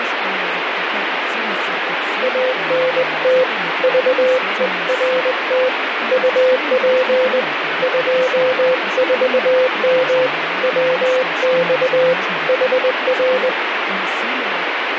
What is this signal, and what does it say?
Morse code, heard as a keyed tone, hand-sent with a straight key, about 20 wpm, 510 Hz, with radio static and speech in Russian. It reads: ANT VERT UP 24M WX HR